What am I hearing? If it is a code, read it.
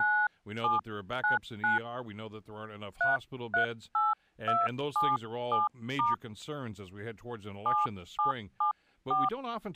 DTMF, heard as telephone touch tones, dialled by hand, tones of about 190 ms, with speech in English. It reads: 9799 338277* 7774